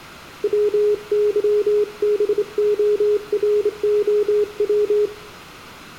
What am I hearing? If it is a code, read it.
Morse code (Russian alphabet), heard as a keyed tone, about 26 wpm, 420 Hz, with room echo. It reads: ВЫБОРОВ